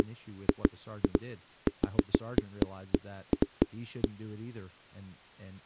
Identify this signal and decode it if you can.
Irregular knocks on a wall, with speech in English. There is no code.